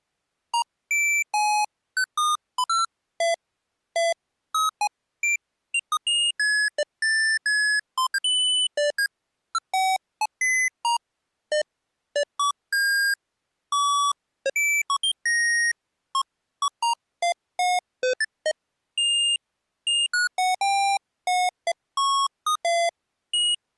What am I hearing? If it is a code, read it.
Electronic bleeps of random pitch and length. There is no code.